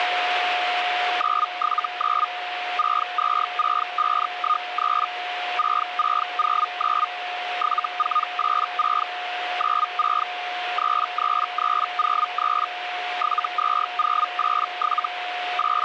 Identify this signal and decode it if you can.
Hellschreiber (Feld-Hell, 122.5 baud), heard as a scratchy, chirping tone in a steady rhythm, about 1230 Hz, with radio static and a steady whistle near 720 Hz. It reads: 979 626513 6609 7486 96 33303 72087 …